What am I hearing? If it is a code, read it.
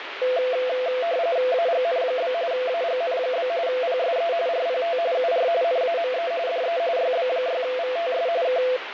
RTTY (45.45 baud, 170 Hz shift), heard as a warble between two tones, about 590 Hz centre, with radio static. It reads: AGN? AGN? PSE RPT UR NAME DE YB6VTS K